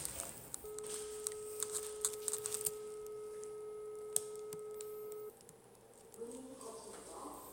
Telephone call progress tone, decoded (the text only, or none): dial tone